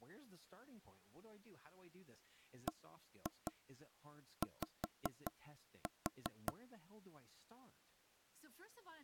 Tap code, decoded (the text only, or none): BY